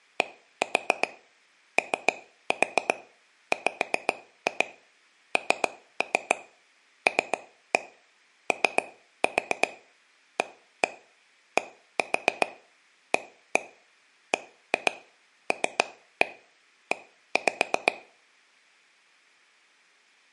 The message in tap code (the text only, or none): DOWNLOADABLE